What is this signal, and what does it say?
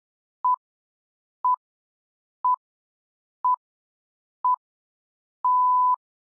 Radio time signal (six pips, as the Greenwich Time Signal), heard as pips.